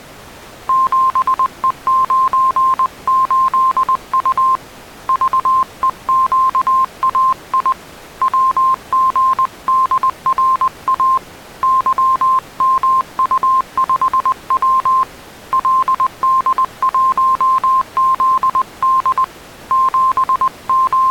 Morse code, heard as a keyed tone, hand-sent with a paddle, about 20 wpm, 1050 Hz. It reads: 7E98U VEQAI WGDRA YMU5W LD1ZD …